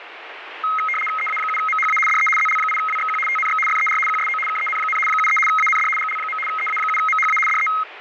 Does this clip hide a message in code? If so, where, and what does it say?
Yes: RTTY (75 baud, 850 Hz shift) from 0.6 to 7.8 s, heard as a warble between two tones, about 1700 Hz centre, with radio static. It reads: EA7MHA DE ZL8WXQ TNX FER QSO KEN, 73 AND GL. EA7MHA DE